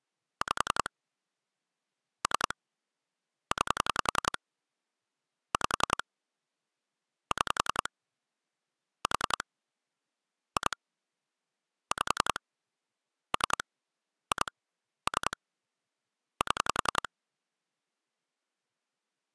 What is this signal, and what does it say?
Pulse dialling, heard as clicks on a phone line, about 10 pulses a second. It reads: 5 3 9 5 6 4 2 5 3 2 3 7